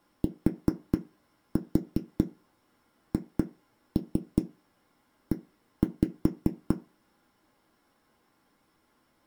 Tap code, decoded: THE

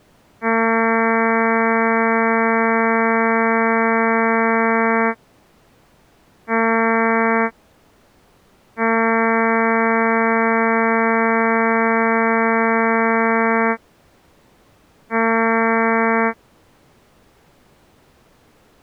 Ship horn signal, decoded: 1 long, 1 short, 1 long, 1 short

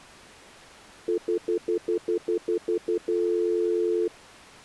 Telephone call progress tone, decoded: stutter dial tone

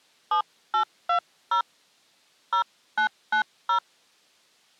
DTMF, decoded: 7820 0990

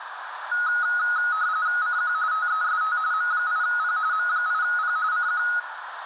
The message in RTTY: CQ TEST M8P M8P CQ

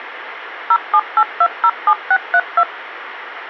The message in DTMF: 078207632

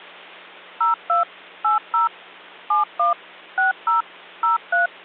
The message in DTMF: 02 80 71 60 03

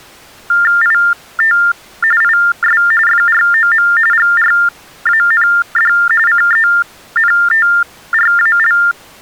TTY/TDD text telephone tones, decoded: IT IS FROM GRAND CENTRAL

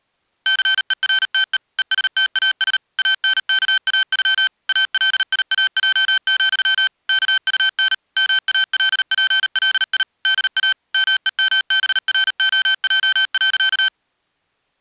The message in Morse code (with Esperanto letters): CERTE ESTAS ANKAŬ ALIAJ, KUN MALPLI DA MEMBROJ.

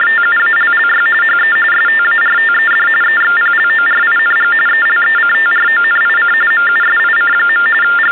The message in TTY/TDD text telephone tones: … HE STARTED EXPLORING ELECTRONIC MUSIC. …

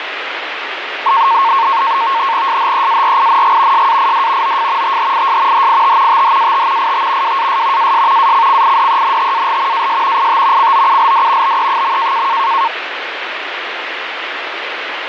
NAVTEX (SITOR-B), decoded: SHEARING SAID OF THIS HIT THAT IT WAS AS ACCIDENTAL AS IT COULD BE.

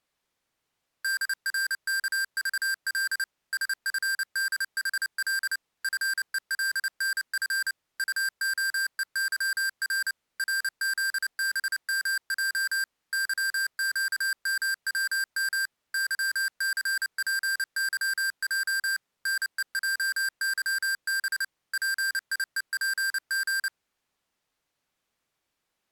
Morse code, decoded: DRKVL SFDHL FELNF UOEYR RZBMJ YQMWM YCPYJ NEJYB PIEPG

